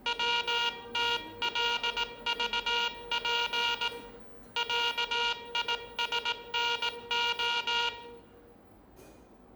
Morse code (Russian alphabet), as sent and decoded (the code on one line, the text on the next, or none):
.-- - .-.. ...- .--. / .-.- .. ... -. ---
ВТЛЖП ЯИСНО